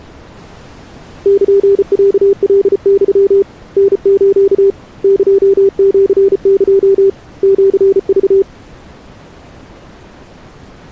Morse code (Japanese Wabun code), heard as a keyed tone, hand-sent with a paddle, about 34 wpm, 390 Hz. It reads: ルロカユ タス エシエ シク